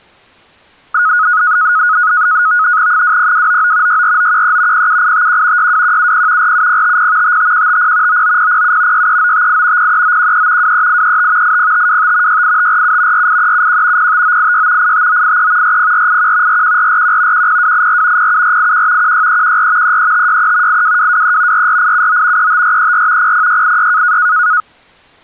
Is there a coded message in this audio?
Yes: NAVTEX (SITOR-B), 100 baud, 170 Hz shift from 0.9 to 24.6 s, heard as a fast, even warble, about 1360 Hz centre. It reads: 20299 64913 07851 62170 47050 55150 99007 63958 03913 23835 80525 68547 48371 05986 85983 40481 41441 10284 07481 16314 33563 82223 44879 35434 00686